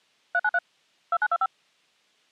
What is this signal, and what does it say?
DTMF, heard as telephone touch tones, dialled by machine, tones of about 50 ms. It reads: 393 2925